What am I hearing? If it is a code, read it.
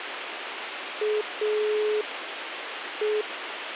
Telephone call progress tone (pulsed, as in Italy), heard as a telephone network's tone, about 420 Hz, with phone line noise. Dial tone.